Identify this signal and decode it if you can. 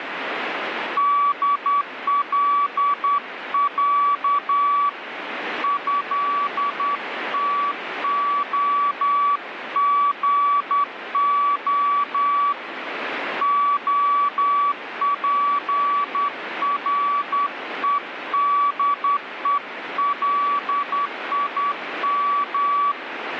Morse code (Russian alphabet), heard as a keyed tone, hand-sent with a straight key, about 10 wpm, 1150 Hz, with radio static. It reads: ДЛЯ ЭТОГО ОПРЕДЕЛИМ